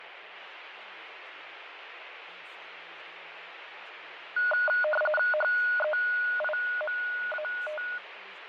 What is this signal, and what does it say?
RTTY (45.45 baud, 850 Hz shift), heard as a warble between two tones, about 1040 Hz centre, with radio static, fading and speech in English. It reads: HEIMAT